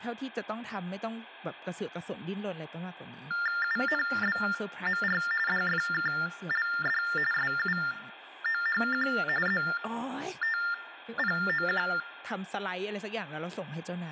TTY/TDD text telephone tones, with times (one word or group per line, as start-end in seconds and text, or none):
3.6-5.2 UNBMR
5.5-7.0 DFKLD
7.3-9.1 SUOHQ
9.5-11.9 ZTPOQ